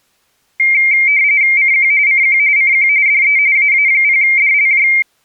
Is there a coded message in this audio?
Yes: RTTY (45.45 baud, 170 Hz shift) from 0.6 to 5.0 s, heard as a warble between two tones, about 2200 Hz centre. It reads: CQ CQ CQ DE AA0DLJ